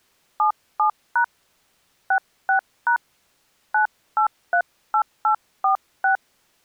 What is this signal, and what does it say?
DTMF, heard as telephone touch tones, dialled by hand, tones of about 100 ms. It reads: 77# 66# 9838846